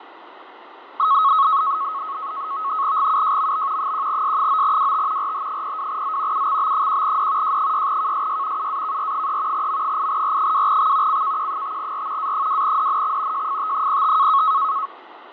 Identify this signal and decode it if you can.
NAVTEX (SITOR-B), 100 baud, 170 Hz shift, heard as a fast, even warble, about 1190 Hz centre, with radio static and fading. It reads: GUJMB 1S9WT RH02Z UXB1D J6KSY UAKR3 M8R2X CKQ5R A2DNX JFT05